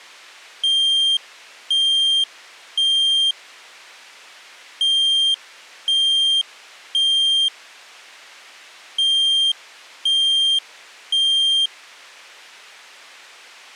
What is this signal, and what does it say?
Alarm pattern, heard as an alarm's beeps, played three times, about 3200 Hz. Temporal three. Smoke or fire, evacuate.